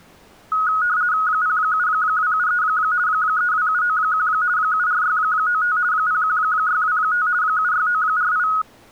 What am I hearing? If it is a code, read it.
RTTY (50 baud, 170 Hz shift), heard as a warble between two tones, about 1360 Hz centre. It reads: 07273 32791 74695 01625 76948